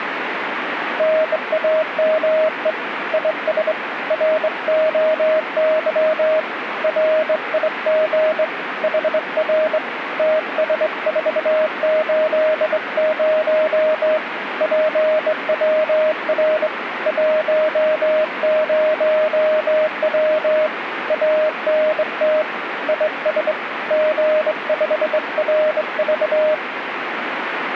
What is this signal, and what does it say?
Morse code, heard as a keyed tone, hand-sent with a straight key, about 22 wpm, 620 Hz, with radio static. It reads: NAME IS ROY RIG HR TS480 PWR 10W ANT IS G5RV